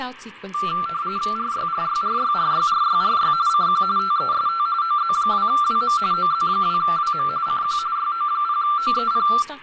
RTTY (45.45 baud, 170 Hz shift), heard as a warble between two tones, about 1260 Hz centre, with radio static, fading, room echo and speech in English. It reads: RYRYRYRYRYRY CQ TEST OZ2WM OZ2WM CQ YO0OEP